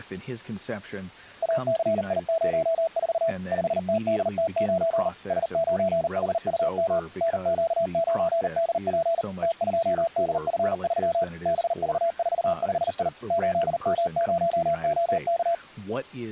Morse code, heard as a keyed tone, machine-sent, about 39 wpm, 660 Hz, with speech in English. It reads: ACI04 5TDT9 S9HUM NQ9DP T2DF3 BV45I 8M0OK